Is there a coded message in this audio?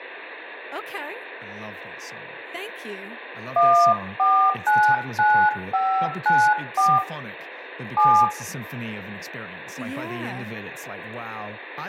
Yes: DTMF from 3.6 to 8.2 s, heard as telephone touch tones, dialled by hand, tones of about 280 ms, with room echo and speech in English. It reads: 1499594 7